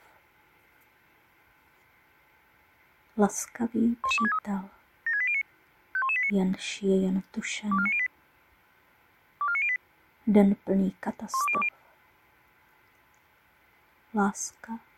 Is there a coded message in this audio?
Yes: five-tone selective call (ZVEI) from 4.0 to 11.7 s, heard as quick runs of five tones, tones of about 70 ms. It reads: 11263 76809 51189 24908 24908 12020